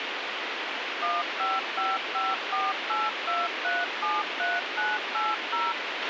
DTMF, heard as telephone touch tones, dialled by machine, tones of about 200 ms, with radio hiss and a squelch burst at the end. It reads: 1555482373980